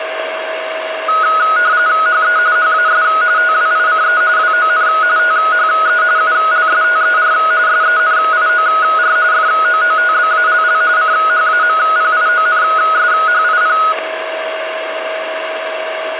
RTTY (45.45 baud, 170 Hz shift), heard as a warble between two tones, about 1360 Hz centre, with radio static, a steady whistle near 640 Hz and room echo. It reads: HE HAS TWICE WON THE ULSTER SENIOR FOOTBALL CHAMPIONSHIP